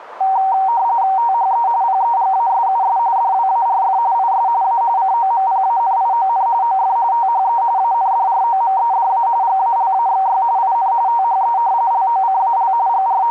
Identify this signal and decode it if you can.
RTTY (45.45 baud, 170 Hz shift), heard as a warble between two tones, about 850 Hz centre, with radio static. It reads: THE PEGASUS DWARF IS A COMPANION OF THE ANDROMEDA GALAXY IN THE LOCAL …